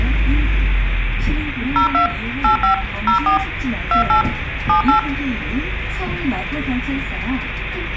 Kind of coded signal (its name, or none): DTMF